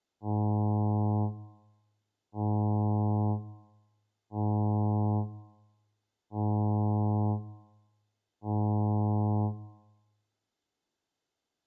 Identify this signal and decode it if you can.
Ship horn signal, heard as a ship's horn, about 100 Hz, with room echo. 5 short. At sea: I doubt that you are doing enough to avoid a collision.